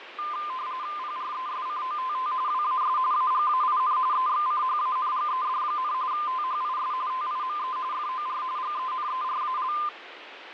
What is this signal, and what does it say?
RTTY (45.45 baud, 170 Hz shift), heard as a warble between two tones, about 1120 Hz centre, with radio static and fading. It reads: PRESCOTT WAS AGAIN EXCHANGED, THIS TIME FOR GENERAL